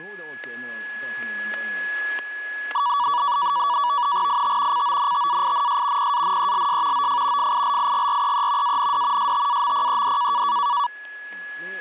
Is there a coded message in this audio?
Yes: NAVTEX (SITOR-B), 100 baud, 170 Hz shift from 2.7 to 10.9 s, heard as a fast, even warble, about 1050 Hz centre, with static crashes, a steady whistle near 1690 Hz and speech in Swedish. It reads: IT CONTAINS PANELS OF FILIGREE AND STAMPED